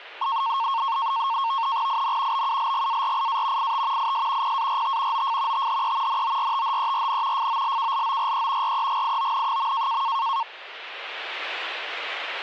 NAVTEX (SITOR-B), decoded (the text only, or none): IN BULGARIA IT IS PART OF THE NORTHERN FOLKLORE REGION.